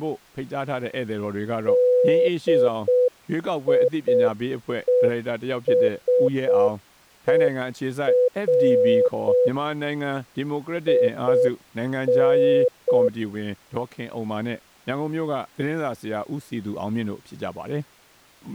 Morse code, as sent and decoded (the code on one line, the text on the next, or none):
-.. .. . ... . .-. / .. -.
DIESER IN